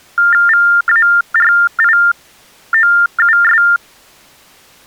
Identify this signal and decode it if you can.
TTY/TDD text telephone tones (45.45 baud Baudot), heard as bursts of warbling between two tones, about 400 Hz shift, 1600 Hz centre. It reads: VARIOUS